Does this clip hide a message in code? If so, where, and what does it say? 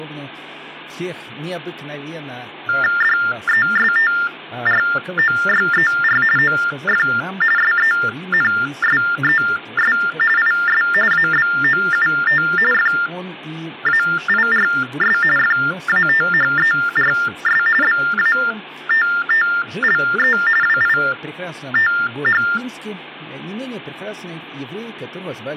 Yes: TTY/TDD text telephone tones (45.45 baud Baudot) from 2.7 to 22.6 s, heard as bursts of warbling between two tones, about 400 Hz shift, 1600 Hz centre, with hum and speech in Russian. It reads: DESTROYER OF SENSES IS ABOUT FAIRS FATHERS BATTLE WITH